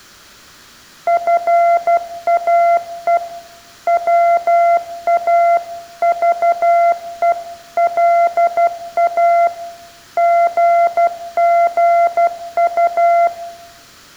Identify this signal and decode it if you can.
Morse code (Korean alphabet), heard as a keyed tone, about 12 wpm, 690 Hz, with room echo. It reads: 놔 보라고 씨